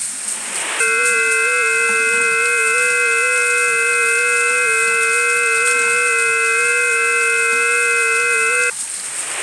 FT8 (several signals at once), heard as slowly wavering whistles, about 6.25 baud, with the noise of a restroom.